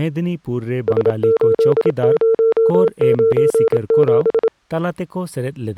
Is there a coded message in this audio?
Yes: Morse code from 0.8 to 4.5 s, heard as a keyed tone, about 27 wpm, 450 Hz, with speech in Santali. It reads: S8097